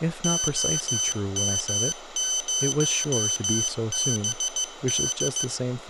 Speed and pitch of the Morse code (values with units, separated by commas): 15 wpm, 3050 Hz